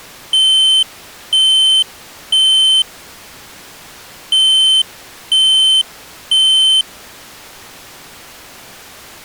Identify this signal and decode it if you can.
Alarm pattern, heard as an alarm's beeps, played twice, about 3100 Hz. Temporal three. Smoke or fire, evacuate.